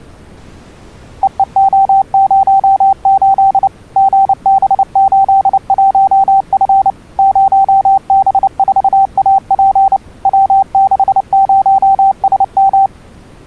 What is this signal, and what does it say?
Morse code, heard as a keyed tone, machine-sent, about 29 wpm, 780 Hz. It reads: EEO08 GB81F 0B4AP W60SM